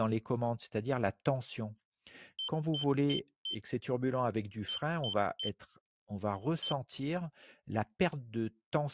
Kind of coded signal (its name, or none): beep code